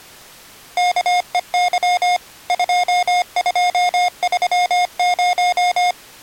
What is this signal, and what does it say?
Morse code, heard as electronic beeps, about 25 wpm, 720 Hz. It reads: KEY 2230